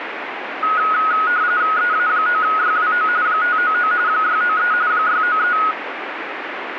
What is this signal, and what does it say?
RTTY (45.45 baud, 170 Hz shift), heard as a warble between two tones, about 1360 Hz centre, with radio static. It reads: EA9YWO 599 693 693